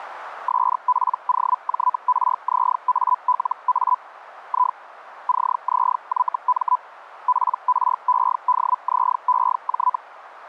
Hellschreiber (Feld-Hell, 122.5 baud), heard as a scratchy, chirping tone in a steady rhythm, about 1000 Hz. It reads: SPOJRZALA I CZYM PREDZEJ